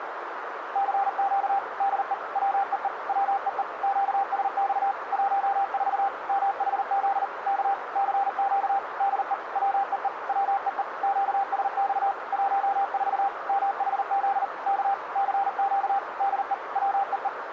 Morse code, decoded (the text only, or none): CQ DE WEE WEE QSX 14 MHZ K CQ DE WEE WEE QSX 14 MHZ K CQ DE WEE